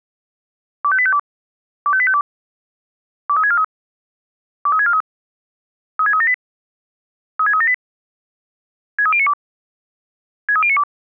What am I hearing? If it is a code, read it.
Five-tone selective call (ZVEI), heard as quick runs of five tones, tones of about 70 ms. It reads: 25852 25852 23643 23643 36378 36378 63092 63092